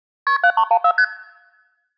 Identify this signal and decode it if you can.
Multi-frequency trunk signalling (R1, as on North American trunks), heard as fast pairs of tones, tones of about 70 ms. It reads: KP 7314 ST